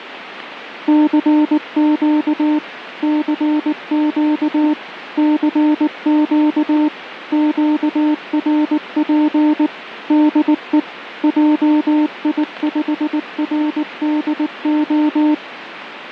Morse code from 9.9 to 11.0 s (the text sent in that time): DE